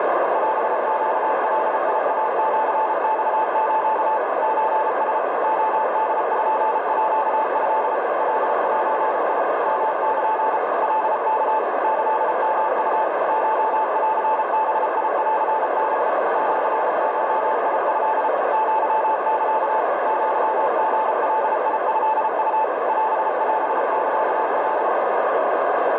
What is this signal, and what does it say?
Morse code (Japanese Wabun code), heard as a keyed tone, machine-sent, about 33 wpm, 880 Hz, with heavy radio static and a narrow filter. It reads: オネガイシマス ソラ レポート カゼ ヨル カワ キヨウ コンバンハ シゴト アサ アリガトウ オオサカ